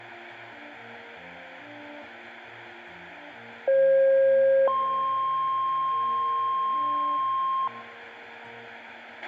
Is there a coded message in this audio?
Yes: two-tone page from 3.7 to 7.7 s, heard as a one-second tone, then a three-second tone, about 540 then 1060 Hz, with a squelch burst at the end.